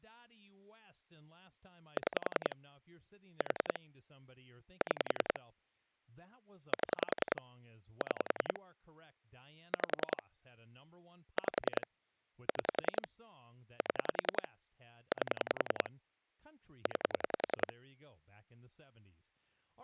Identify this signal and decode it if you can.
Pulse dialling, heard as clicks on a phone line, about 10 pulses a second, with speech in English. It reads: 6 4 6 7 6 5 5 6 7 8 9